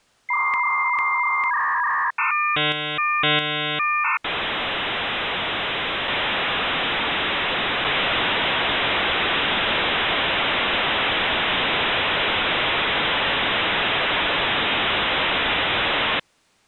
Dial-up modem handshake (V.34 or later), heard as a whistle, warbles, then hiss.